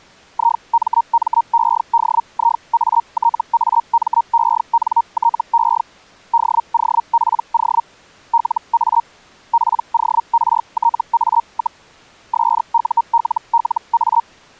Hellschreiber (Feld-Hell, 122.5 baud), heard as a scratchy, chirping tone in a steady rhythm, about 930 Hz. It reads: IMMEDIATAMENTE DOPO LA PORTA, SULLA